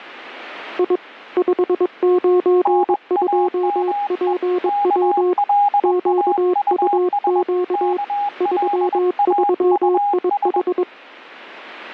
Morse code, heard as two keyed tones. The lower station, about 22 wpm, 360 Hz: I 592PW QUQ 33IH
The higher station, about 21 wpm, 820 Hz: NAME KLAUS KLAUS